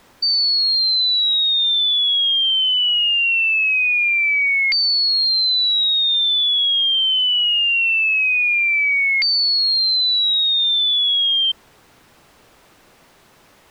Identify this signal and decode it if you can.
A tone that sweeps in pitch again and again. There is no code.